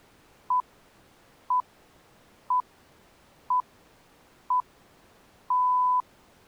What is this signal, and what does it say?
Radio time signal (six pips, as the Greenwich Time Signal), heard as pips.